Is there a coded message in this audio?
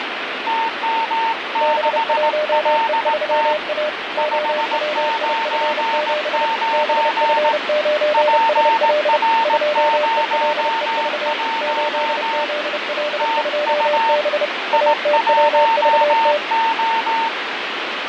Yes: Morse code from 0.4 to 17.3 s, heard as two keyed tones, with radio static. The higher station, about 18 wpm, 910 Hz: TM6LT 599 PR01 TU I1O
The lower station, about 30 wpm, 600 Hz: B1E3A OWIF7 BF9SL 2ELEV 8ZL2B ATWVT